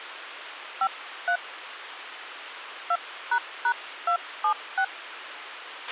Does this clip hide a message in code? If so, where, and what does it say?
Yes: DTMF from 0.8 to 4.8 s, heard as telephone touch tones, dialled by hand, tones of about 80 ms, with radio hiss and a squelch burst at the end. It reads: 53 2##276